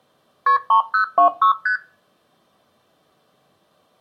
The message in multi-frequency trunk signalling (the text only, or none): KP 3026 ST